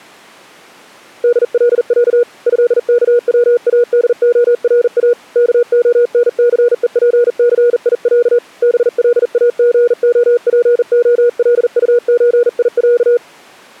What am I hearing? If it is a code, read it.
Morse code (Russian alphabet), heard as a keyed tone, hand-sent with a bug key, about 40 wpm, 480 Hz. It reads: ДЛЯ ЭКВАДОРА КОНЦЕПЦИЯ БЛАГОПОЛУЧИЯ